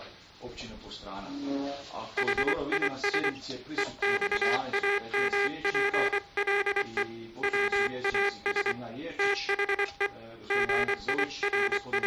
Morse code, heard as a buzzer, hand-sent with a paddle, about 24 wpm. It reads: HIS EXAMPLE WAS THE …